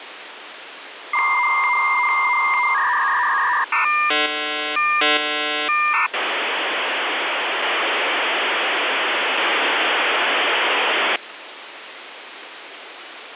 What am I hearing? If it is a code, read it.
Dial-up modem handshake (V.34 or later), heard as a whistle, warbles, then hiss, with phone line noise.